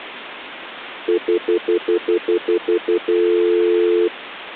Telephone call progress tone (North American plan), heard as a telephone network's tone, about 350, 440 Hz, 0.1 s on and 0.1 s off. Stutter dial tone.